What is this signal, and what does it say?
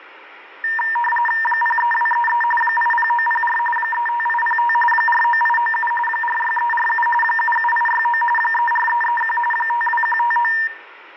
RTTY (45.45 baud, 850 Hz shift), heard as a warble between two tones, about 1370 Hz centre, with radio static and room echo. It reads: 03233 80904 35805 49897 46347 77869 34331 52159